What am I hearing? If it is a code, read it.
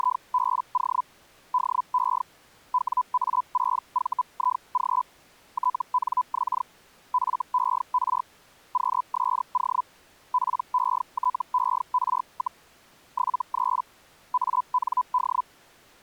Hellschreiber (Feld-Hell, 122.5 baud), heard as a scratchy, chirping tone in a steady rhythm, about 1000 Hz. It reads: … DE WA6VIG TNX FER QSO PETER, 73 AND